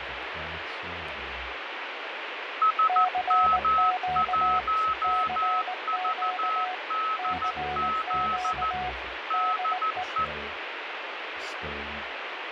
Morse code, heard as two keyed tones, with radio static and fading. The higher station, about 14 wpm, 1290 Hz: SM1VDZ DE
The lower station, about 19 wpm, 730 Hz: CQ CQ CQ DE